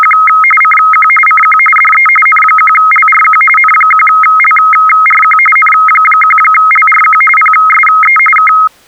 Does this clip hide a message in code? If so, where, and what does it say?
Yes: RTTY (45.45 baud, 850 Hz shift) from 0.0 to 8.7 s, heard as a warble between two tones, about 1700 Hz centre. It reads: … CQ CQ DE N1LRQ N1LRQ N1LRQ PSE K